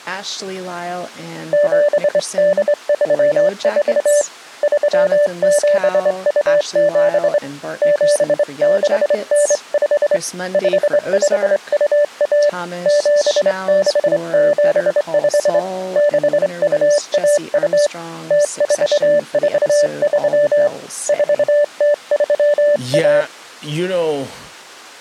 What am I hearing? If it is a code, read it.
Morse code (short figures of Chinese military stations), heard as a keyed tone, hand-sent with a straight key, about 25 wpm, 590 Hz, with speech in English. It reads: 7834 3727 7695 5521 7675 6212 0443 4031